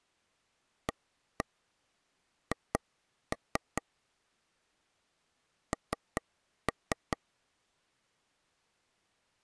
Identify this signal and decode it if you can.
Tap code, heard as taps on a table, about 5 knocks a second. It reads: AH N